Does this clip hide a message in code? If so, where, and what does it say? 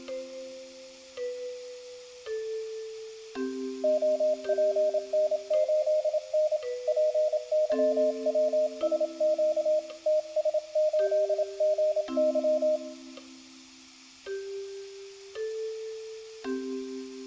Yes: Morse code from 3.8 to 12.8 s, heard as a keyed tone, hand-sent with a paddle, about 27 wpm, 620 Hz, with room echo. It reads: OPN8N PYWSQ TS8GY